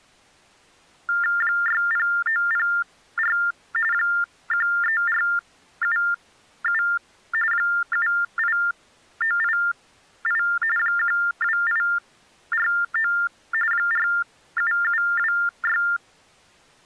TTY/TDD text telephone tones (45.45 baud Baudot), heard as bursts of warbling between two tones, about 400 Hz shift, 1600 Hz centre. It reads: 60904 13477 78988 12849 47726